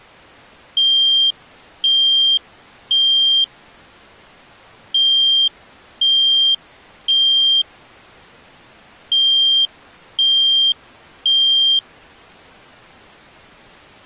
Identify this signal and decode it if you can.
Alarm pattern, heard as an alarm's beeps, played three times, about 3200 Hz. Temporal three. Smoke or fire, evacuate.